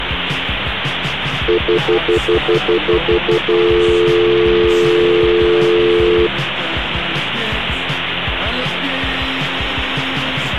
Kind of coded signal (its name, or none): telephone call progress tone